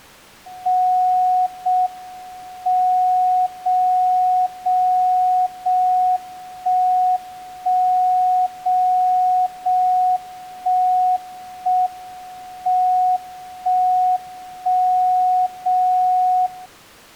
Radio time signal (JJY), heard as a tone whose level steps once a second, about 740 Hz. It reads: 0 M 0 0 0 1 1 0 0 1 1 M 1 1 0 0